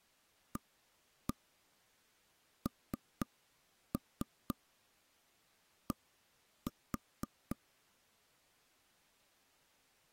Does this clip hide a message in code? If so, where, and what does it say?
Yes: tap code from 0.6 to 7.6 s, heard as taps on a table, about 4 knocks a second. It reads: AND